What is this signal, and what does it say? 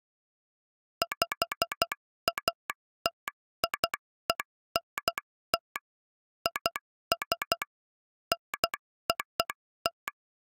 Morse code (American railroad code), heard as a telegraph sounder, machine-sent. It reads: PATIENT IS NOT